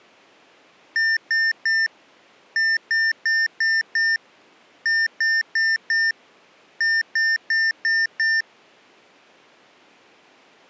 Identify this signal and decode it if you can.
Beep code, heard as beeps from a small speaker, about 1800 Hz. 3-5-4-5.